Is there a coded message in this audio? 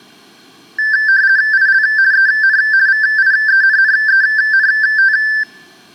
Yes: RTTY (50 baud, 170 Hz shift) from 0.8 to 5.4 s, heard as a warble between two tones, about 1650 Hz centre. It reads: IL EN VIENNENT